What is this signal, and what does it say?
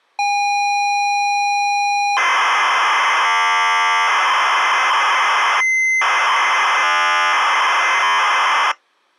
ZX Spectrum tape loading, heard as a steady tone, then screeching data.